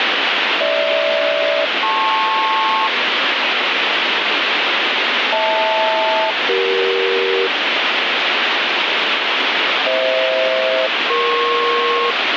Aircraft SELCAL, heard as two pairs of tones, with heavy radio static. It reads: GH-LP HL-CE FH-EP